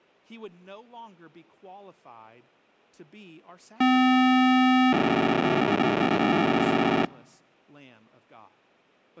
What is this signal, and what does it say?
POCSAG pager data (512 baud), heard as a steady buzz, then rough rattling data, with speech in English.